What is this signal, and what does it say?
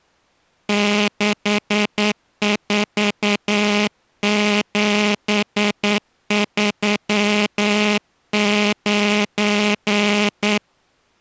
Morse code, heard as a buzzer, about 9 wpm. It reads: 64739